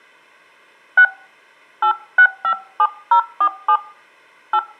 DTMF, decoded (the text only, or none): 6 8657047 8